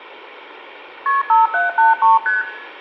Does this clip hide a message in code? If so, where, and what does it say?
Yes: multi-frequency trunk signalling (R1, as on North American trunks) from 1.1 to 2.4 s, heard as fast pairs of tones, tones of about 160 ms, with room echo. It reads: KP 5783 ST